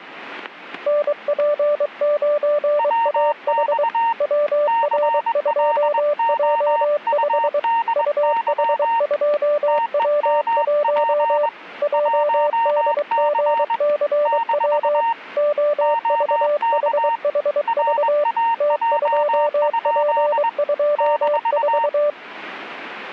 Morse code, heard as two keyed tones, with static crashes. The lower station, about 23 wpm, 590 Hz: NP9AH WR2J5 UH2W1 JDGCW OVHHV T2P24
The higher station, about 21 wpm, 920 Hz: WX CLOUDY TEMP 1C - OK RAJ? -